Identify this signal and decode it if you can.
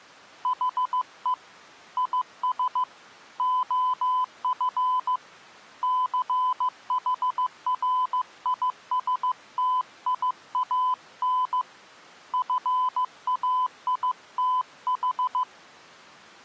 Morse code, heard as a keyed tone, hand-sent with a paddle, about 15 wpm, 1010 Hz. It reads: HE IS OF CHRISTIAN FAITH